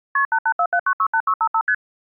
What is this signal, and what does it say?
Multi-frequency trunk signalling (R1, as on North American trunks), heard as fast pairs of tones, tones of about 70 ms. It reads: KP 8847968655 ST